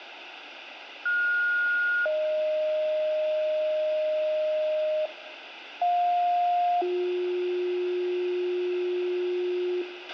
Two-tone page, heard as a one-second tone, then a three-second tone, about 1430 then 620 Hz, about 710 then 360 Hz, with radio hiss, a squelch burst at the end and room echo.